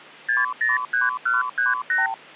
Multi-frequency trunk signalling (R2, with the far end's replies), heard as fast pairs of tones, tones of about 160 ms. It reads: 603138